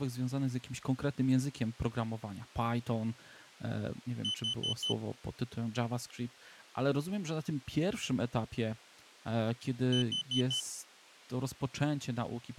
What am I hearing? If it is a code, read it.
Alarm pattern, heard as an alarm's beeps, played twice, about 3050 Hz, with speech in Polish. Temporal four. Carbon monoxide.